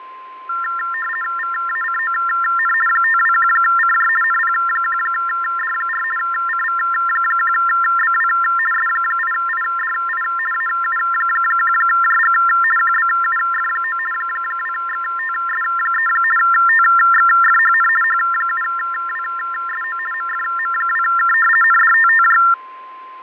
RTTY (50 baud, 450 Hz shift), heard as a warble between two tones, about 1600 Hz centre, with fading and a steady whistle near 1040 Hz. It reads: VACON 521CJ NP1D4 CV1BW S8IDI AU1JG QBUF9 2XTS3 TXFHN H7WSO MFM2K NDTTJ